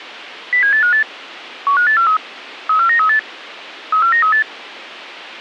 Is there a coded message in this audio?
Yes: five-tone selective call (CCIR) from 0.5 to 4.4 s, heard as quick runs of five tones, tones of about 100 ms. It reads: 07858 15843 34938 34938